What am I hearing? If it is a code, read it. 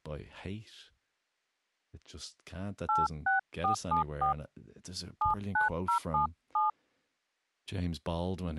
DTMF, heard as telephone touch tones, dialled by hand, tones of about 140 ms, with speech in English. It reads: 86474 79077